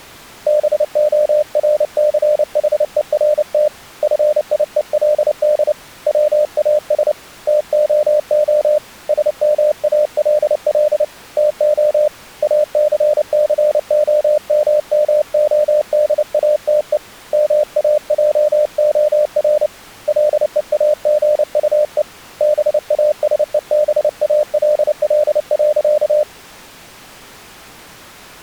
Morse code, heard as a keyed tone, hand-sent with a paddle, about 29 wpm, 600 Hz. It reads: BORCHERT FIELD WAS TOO SMALL TO ACCOMMODATE MAJOR LEAGUE BASEBALL.